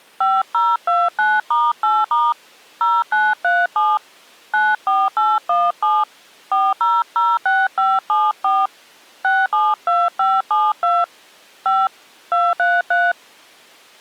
DTMF, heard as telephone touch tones, dialled by hand, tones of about 210 ms. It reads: 5029*8* 0937 94817 4006574 672572 5 233